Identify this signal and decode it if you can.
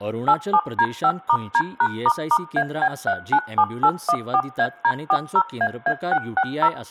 DTMF, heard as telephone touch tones, dialled by machine, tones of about 60 ms, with room echo and speech in Goan Konkani. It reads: 87D5*D#**AB397814AD40AA660